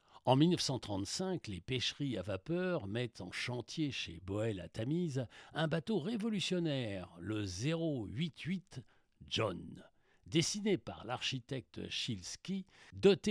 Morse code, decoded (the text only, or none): none